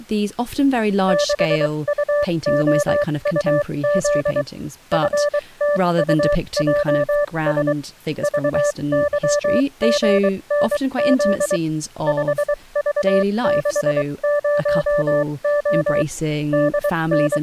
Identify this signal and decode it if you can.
Morse code, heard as a keyed tone, machine-sent, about 23 wpm, spaced as for 20 wpm, 580 Hz, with speech in English. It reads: 6UOUZ FTUJS VYGNZ 5V60O …